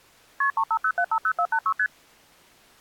Multi-frequency trunk signalling (R1, as on North American trunks), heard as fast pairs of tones, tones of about 70 ms. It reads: KP 350750486 ST